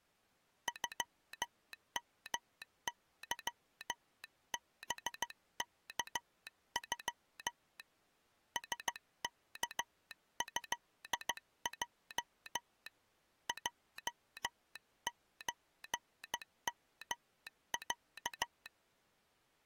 Morse code (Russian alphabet), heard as a telegraph sounder, hand-sent with a bug key, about 15 wpm. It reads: ЮМЫБКЮ СКЭЙ ЙЧМЯ